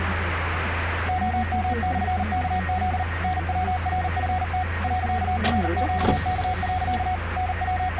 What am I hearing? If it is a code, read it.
Morse code, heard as a keyed tone, machine-sent, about 39 wpm, 740 Hz, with radio static, a weaker station near 1870 Hz and the noise inside a car. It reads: OM/KZ NWRFT .RQK. …